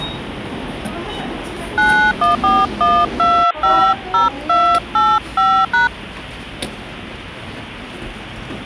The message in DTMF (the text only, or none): 9141250285#